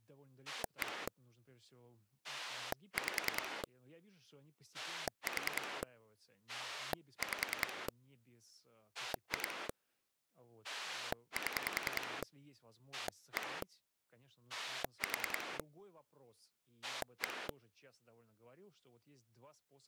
Pulse dialling, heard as a rotary dial, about 10 pulses a second, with speech in Russian. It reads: 1 5 4 5 2 7 1 4 1